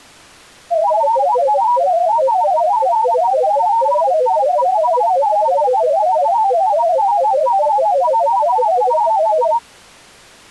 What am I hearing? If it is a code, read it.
Multi-tone FSK (Olivia or MFSK type), about 500 Hz wide, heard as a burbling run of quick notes, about 31.25 baud.